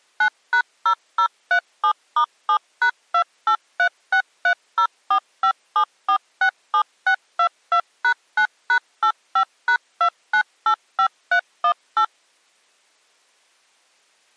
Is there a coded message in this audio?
Yes: DTMF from 0.2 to 12.0 s, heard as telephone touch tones, dialled by machine, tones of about 80 ms. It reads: 9#0037*7#283630457467622#9#85#2985318